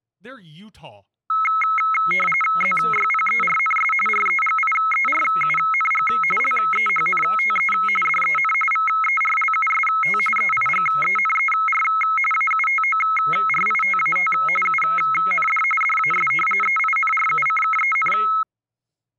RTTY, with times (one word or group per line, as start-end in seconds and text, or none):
2.6-3.9 ZYPERNS
4.1-6.1 REGIERUNG
6.4-7.7 LEHNTE
8.1-8.5 DEN
8.7-10.2 VERLUST
10.4-11.8 EIGENER
12.3-14.3 AUTORITAT
14.7-15.6 UND
15.8-16.3 DAS
16.6-18.1 EINRUCKEN